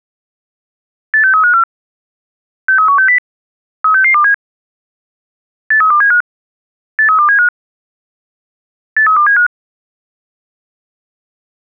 Five-tone selective call (CCIR), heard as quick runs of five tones, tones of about 100 ms. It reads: 86354 63160 36627 83275 83275 83275